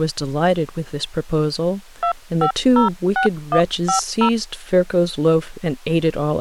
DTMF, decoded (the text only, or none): 2506150